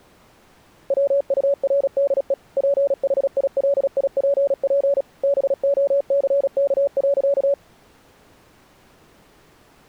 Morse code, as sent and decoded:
.-- ..- .-. -.. . / .--. .... .. .-.. .. .--. .--. / -... --- -.-. -.- .-.-.-
WURDE PHILIPP BOCK.

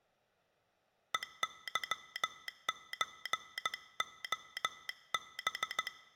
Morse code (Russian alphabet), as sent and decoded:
. -.-- ---. --- -...
ЕЫЧОБ

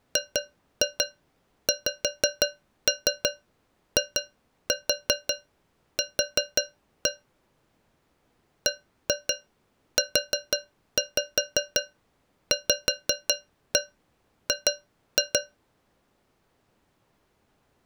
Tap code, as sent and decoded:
2-2 5-3 2-4 4-1 / 1-2 4-5 5-1 2-2
GXIQ BUVG

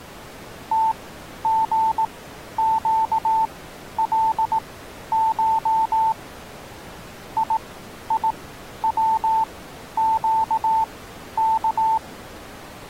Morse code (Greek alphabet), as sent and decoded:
- --. --.- .-.. ---- / .. .. .-- --.- -.-
ΤΓΨΛΧ ΙΙΩΨΚ

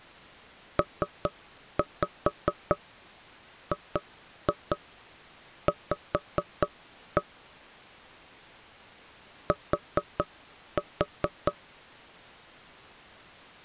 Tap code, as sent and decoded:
3-5 2-2 5-1 / 4-4
PGV T

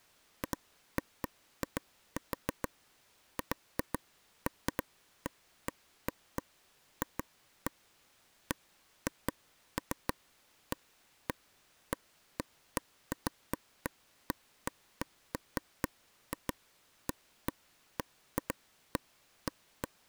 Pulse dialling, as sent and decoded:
none

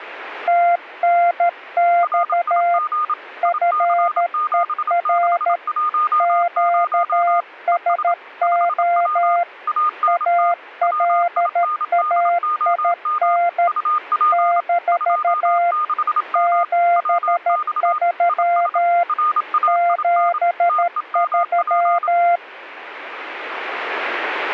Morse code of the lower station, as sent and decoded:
- -. -..- / ..-. . .-. / --.- ... --- / .- .-.. .- .. -. / -....- / --... ...-- / --... ...--
TNX FER QSO ALAIN - 73 73

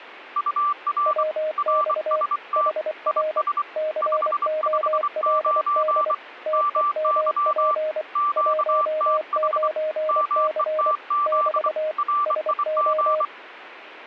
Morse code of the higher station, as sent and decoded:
..- .-. / .-. ... - / .. ... / ..... ..... ----. / -- -.-- / --.- - .... / -- . - --.. / .-. .. --.
UR RST IS 559 MY QTH METZ RIG

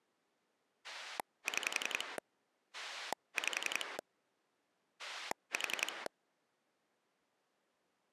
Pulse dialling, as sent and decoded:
6 / 5 / 4
6 5 4

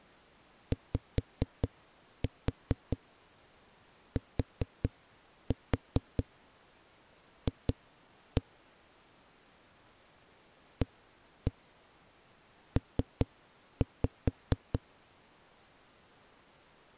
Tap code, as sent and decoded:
5-4 4-4 2-1 / 1-1 3-5
YTF AP

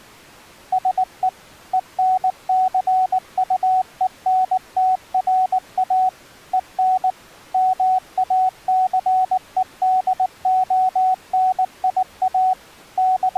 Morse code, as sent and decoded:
... . / . -. -.-. ..- . -. - .-. .- / . -. / -- .- -.-. . -.. --- -. .. .- / …
SE ENCUENTRA EN MACEDONIA …

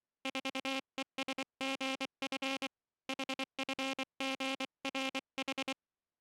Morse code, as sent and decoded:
....- . ... --. ..-. / .... ..-. --. .-. ....
4ESGF HFGRH

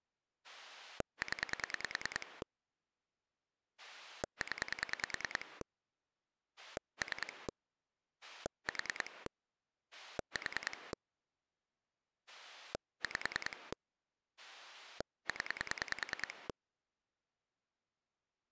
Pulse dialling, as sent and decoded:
10 / 10 / 3 / 4 / 4 / 5 / 10
0 0 3 4 4 5 0

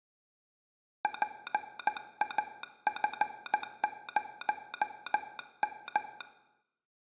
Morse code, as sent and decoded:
.--. .- ..-. ----- --
PAF0M

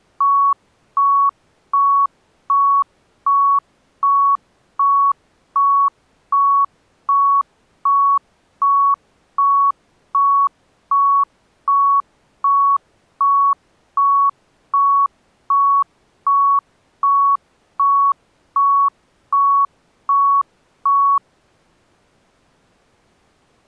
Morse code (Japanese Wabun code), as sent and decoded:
none

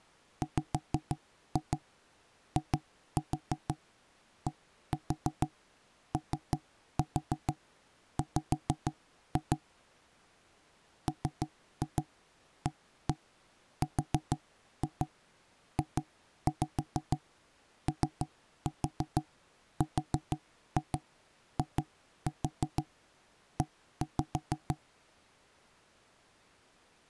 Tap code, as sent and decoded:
5-2 2-4 1-4 3-4 5-2 / 3-2 1-1 4-2 2-5 3-4 4-2 2-4 1-5
WIDOW MARJORIE

